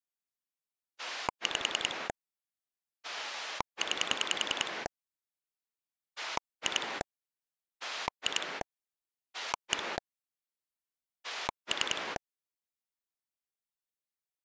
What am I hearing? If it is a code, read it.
Pulse dialling, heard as a rotary dial, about 10 pulses a second. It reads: 5 9 2 2 1 3